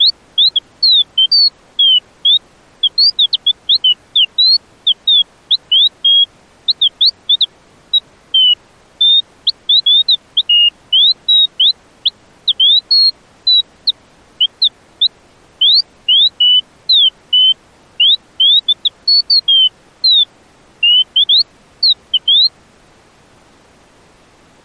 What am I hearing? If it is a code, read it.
Bird-like chirps. There is no code.